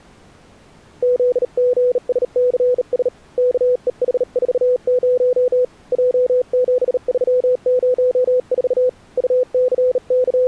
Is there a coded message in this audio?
Yes: Morse code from 1.0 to 10.5 s, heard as a keyed tone, hand-sent with a bug key, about 38 wpm, 500 Hz. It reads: ZGSCS KEH40 J7304 …